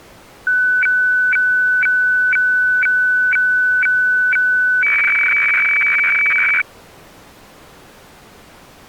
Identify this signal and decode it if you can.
Weather fax (radiofax), 120 lines a minute, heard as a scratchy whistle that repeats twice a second.